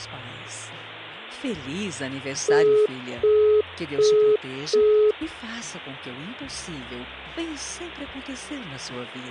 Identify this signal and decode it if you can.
Telephone call progress tone (as in the UK, Australia and similar networks), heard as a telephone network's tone, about 420 Hz, 0.375 s on and 0.375 s off, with hum. Busy tone.